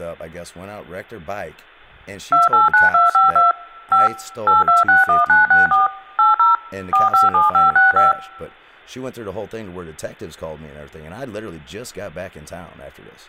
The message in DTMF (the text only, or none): 289252 5 8261964 80 457565